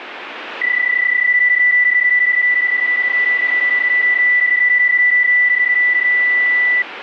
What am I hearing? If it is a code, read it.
PSK31 (31.25 baud), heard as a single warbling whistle, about 2000 Hz, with radio static.